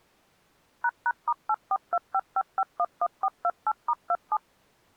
DTMF, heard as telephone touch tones, dialled by machine, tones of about 50 ms. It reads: ##*84255511428*27